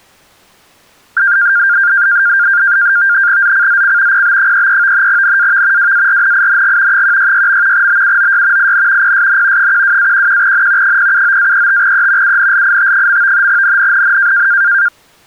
NAVTEX (SITOR-B), 100 baud, 170 Hz shift, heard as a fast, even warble, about 1500 Hz centre. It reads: ZCZC PB33 NAV WARNING 166. BUOY IN PSN 12-11N 079-35E UNLIT. NNNN